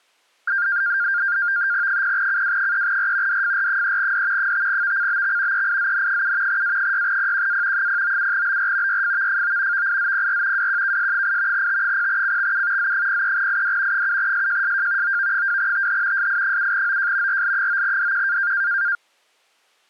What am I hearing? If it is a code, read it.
NAVTEX (SITOR-B), 100 baud, 170 Hz shift, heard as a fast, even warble, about 1500 Hz centre. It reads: 0CW3R DFR3D 5VCBX EIZN7 A6PQA 097BR YFVFO VIZPR WQKS8 T0CXU Z03ID 7SJSJ OV2TH SI7OJ RL9DQ